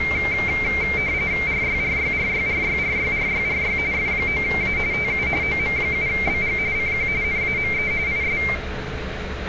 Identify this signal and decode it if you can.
RTTY (45.45 baud, 170 Hz shift), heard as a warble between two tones, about 2200 Hz centre, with radio static, room echo and street noise. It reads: RYRYRYRYRYRYRY F9A TU OM7BG CQ NAME IS